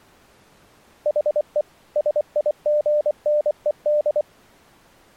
Morse code, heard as a keyed tone, machine-sent, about 24 wpm, 600 Hz. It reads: HE SIGNED